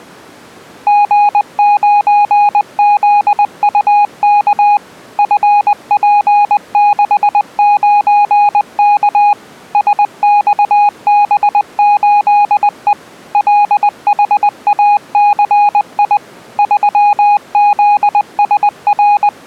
Morse code, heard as a keyed tone, machine-sent, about 20 wpm, 820 Hz. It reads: G9ZUK FP69K SXB8E LHACI …